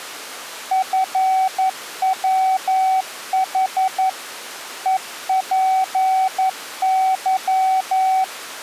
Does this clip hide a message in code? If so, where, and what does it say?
Yes: Morse code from 0.7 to 8.3 s, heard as a keyed tone, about 11 wpm, 760 Hz. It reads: FWH EPY